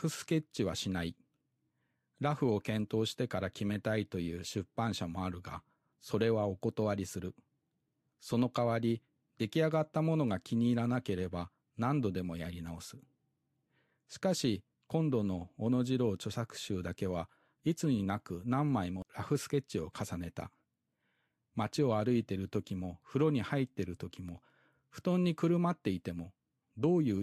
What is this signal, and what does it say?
Speech in Japanese. There is no code.